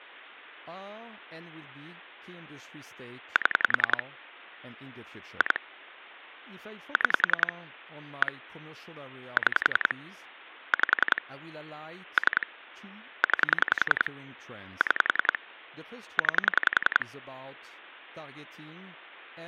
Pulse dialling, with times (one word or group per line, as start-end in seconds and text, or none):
3.4-4.0 7
5.4-5.6 2
7.0-7.5 6
8.2-8.3 1
9.4-9.9 6
10.7-11.2 5
12.2-12.5 3
13.2-14.1 9
14.8-15.4 6
16.2-17.1 9